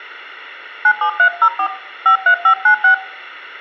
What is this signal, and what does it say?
DTMF, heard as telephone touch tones, dialled by hand, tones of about 90 ms, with room echo. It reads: 97304 53596